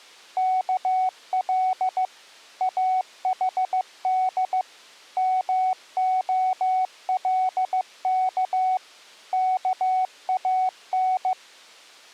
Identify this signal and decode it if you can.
Morse code (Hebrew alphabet), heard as a keyed tone, machine-sent, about 15 wpm, 750 Hz. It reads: כל אחד מהלך כאן